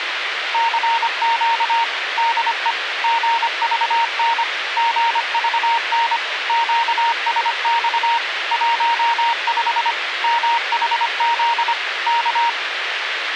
Morse code, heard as a keyed tone, machine-sent, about 25 wpm, 930 Hz, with radio hiss. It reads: CQ DE GVN GVN QSX 15 MHZ K